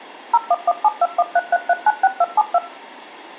DTMF, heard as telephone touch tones, dialled by machine, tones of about 40 ms, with room echo. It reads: 01172133396272